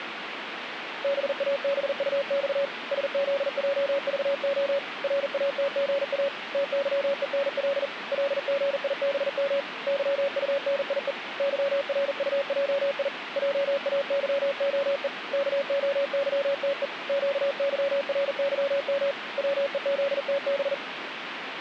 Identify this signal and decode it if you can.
Morse code, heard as a keyed tone, hand-sent with a paddle, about 40 wpm, 560 Hz, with radio static. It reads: BABUX SZJVO RATGA TYENL LGIBM YUNIE YRUJI JAYOE KOYTE QYRYM WEZTB